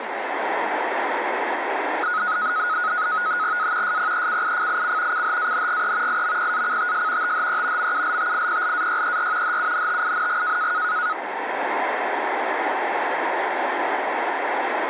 NAVTEX (SITOR-B), 100 baud, 170 Hz shift, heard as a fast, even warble, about 1360 Hz centre, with radio static and speech in English. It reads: A SPECIFIC CHANGE IMPACTS THE MULTIPLAYER HUNTING